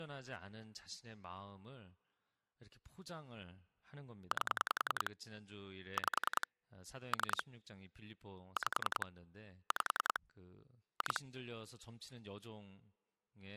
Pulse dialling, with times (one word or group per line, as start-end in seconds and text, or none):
4.3-5.1 8
6.0-6.5 5
7.1-7.4 3
8.6-9.1 5
9.7-10.2 5
11.0-11.2 2